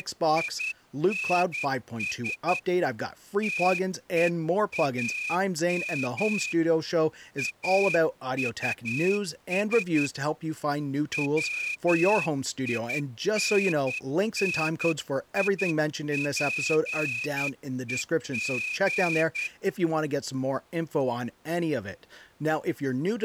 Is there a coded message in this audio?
Yes: Morse code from 0.0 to 19.5 s, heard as a whistle, hand-sent with a straight key, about 10 wpm, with speech in English. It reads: … TEAM AUS WINNIPEG